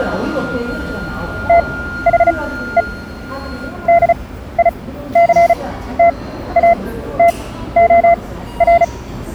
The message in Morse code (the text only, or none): THE DICTATOR